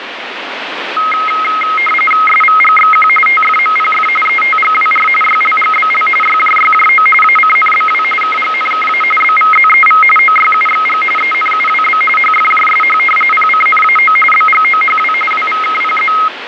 RTTY (45.45 baud, 850 Hz shift), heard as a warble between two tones, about 1700 Hz centre, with radio static. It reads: SVGXQ TFMPF ETGWR YLGBL YJYJO ACNBW KGNKA BVZEV OYUXG ENUWB HFJSH PCNAO BGOHW WVKPZ